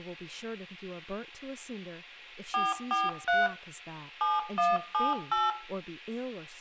DTMF, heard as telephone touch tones, dialled by machine, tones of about 190 ms, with room echo and speech in English. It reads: 443 7178